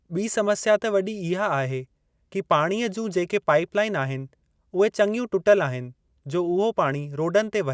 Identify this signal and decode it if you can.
Speech in Sindhi. There is no code.